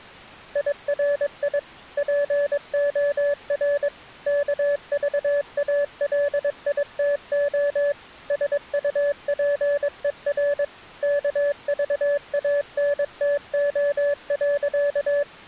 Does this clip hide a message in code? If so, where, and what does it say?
Yes: Morse code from 0.5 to 15.3 s, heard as a keyed tone, machine-sent, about 22 wpm, 580 Hz. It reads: IRI POR KVALITO SUPER KVANTO.